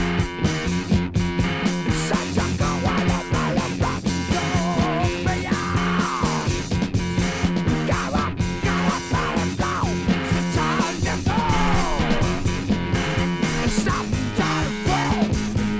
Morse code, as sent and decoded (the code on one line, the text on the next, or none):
none